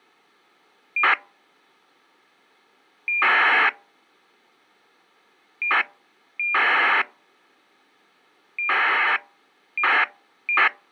ACARS aircraft data, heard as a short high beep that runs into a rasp, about 2400 baud.